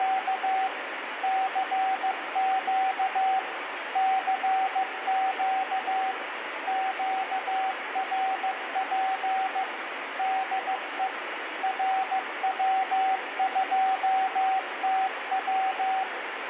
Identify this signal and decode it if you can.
Morse code, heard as a keyed tone, machine-sent, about 15 wpm, 760 Hz, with radio static and room echo. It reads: … CQ CQ QRP DE RW2TW